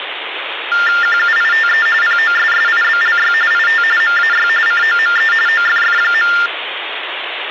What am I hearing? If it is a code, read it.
TTY/TDD text telephone tones (45.45 baud Baudot), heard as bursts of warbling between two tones, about 400 Hz shift, 1600 Hz centre, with phone line noise. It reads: QUITE POSSIBLY IT MAY COME OFF.